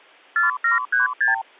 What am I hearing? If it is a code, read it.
Multi-frequency trunk signalling (R2, with the far end's replies), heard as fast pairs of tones, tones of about 140 ms. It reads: 4736